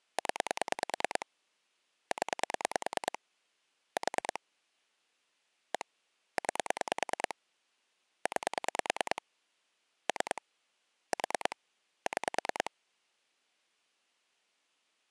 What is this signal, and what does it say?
Pulse dialling, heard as clicks on a phone line, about 9 pulses a second. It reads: 0 0 4 1 9 9 3 4 6